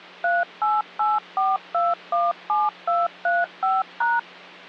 DTMF, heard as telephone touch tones, dialled by machine, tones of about 190 ms, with hum. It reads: 3884217235#